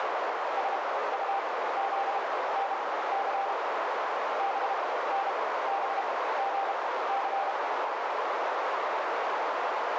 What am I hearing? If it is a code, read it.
Morse code (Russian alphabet), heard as a keyed tone, machine-sent, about 32 wpm, spaced as for 17 wpm, 790 Hz, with heavy radio static and a narrow filter. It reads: СУЗНЦ БНБГЦ